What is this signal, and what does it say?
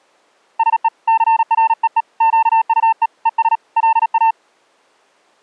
Morse code, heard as a keyed tone, hand-sent with a paddle, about 37 wpm, 900 Hz. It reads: SE CREE QUE ES LA